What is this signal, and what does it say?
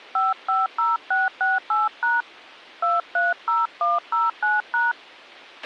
DTMF, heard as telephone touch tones, dialled by hand, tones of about 180 ms, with a squelch burst at the end. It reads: 550668# 230109#